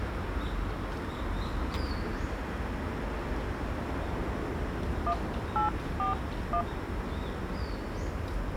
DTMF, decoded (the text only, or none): 1841